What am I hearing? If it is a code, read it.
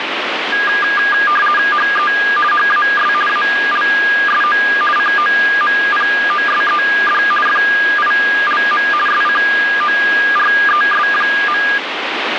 RTTY (50 baud, 450 Hz shift), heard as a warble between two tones, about 1420 Hz centre, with radio static. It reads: HE HAS ALSO COMPOSED FILM SCORES.